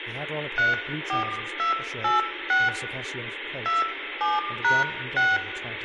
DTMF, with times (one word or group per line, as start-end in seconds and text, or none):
0.6-2.7 34286
3.7-5.4 27#6